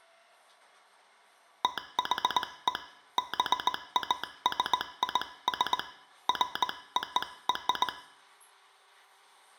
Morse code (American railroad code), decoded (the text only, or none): THE BASIS FOR